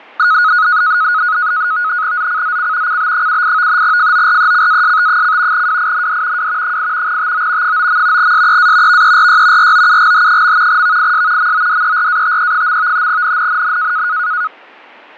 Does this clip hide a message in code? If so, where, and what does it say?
Yes: NAVTEX (SITOR-B), 100 baud, 170 Hz shift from 0.2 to 14.5 s, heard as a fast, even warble, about 1360 Hz centre, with fading. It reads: ZCZC CB78 FORECAST: WIND W 8 TO 9. SEA VERY ROUGH. VIS MODERATE. NNNN